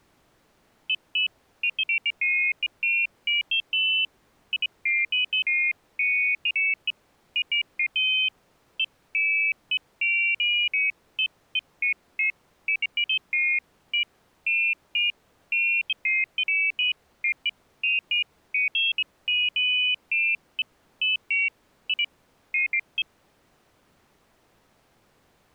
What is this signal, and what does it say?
Pairs of high tones at irregular times. There is no code.